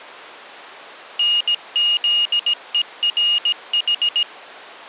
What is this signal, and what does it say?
Morse code (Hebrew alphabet), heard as a high beeper, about 17 wpm, 2850 Hz. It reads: נזורח